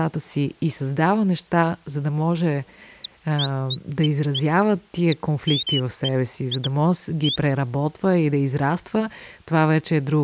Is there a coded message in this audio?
No, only bird-like chirps, with speech in Bulgarian.